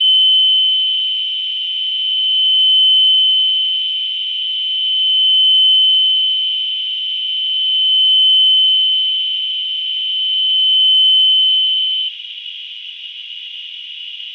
A steady tone, with radio static, fading, a narrow filter and room echo. There is no code.